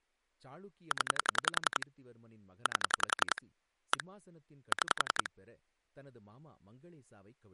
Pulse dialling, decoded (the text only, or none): 0 8 1 6